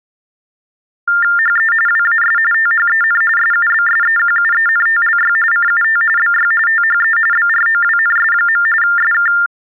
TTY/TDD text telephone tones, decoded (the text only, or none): HE WAS THEN SUBSEQUENTLY CUT BY THE BROWNS. SK